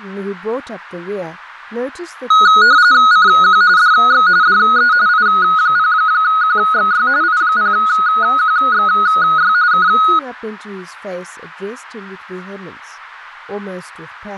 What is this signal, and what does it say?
RTTY (45.45 baud, 170 Hz shift), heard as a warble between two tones, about 1360 Hz centre, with speech in English. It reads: CQ DX DE I0QXY I0QXY K